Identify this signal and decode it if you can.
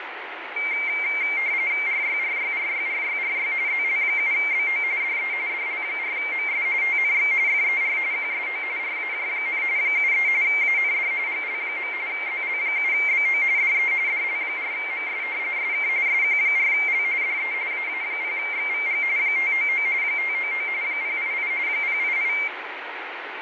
RTTY (45.45 baud, 170 Hz shift), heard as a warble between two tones, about 2200 Hz centre, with radio static and fading. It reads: RYRYRYRYRY ZL7BO DE DL4MS TNX FER QSO RAJ, 73 AND GL. ZL7BO DE DL4MS SK SQ4L DE AA0XVG 599 599 088 088